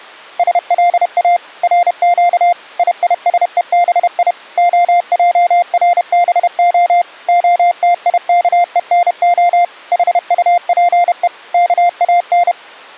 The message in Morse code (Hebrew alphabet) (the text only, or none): שלא רק יישובי הערבה התיכונה חטפו כאן